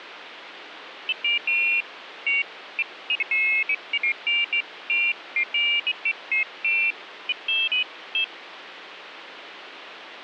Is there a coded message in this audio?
No, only pairs of high tones at irregular times, with phone line noise.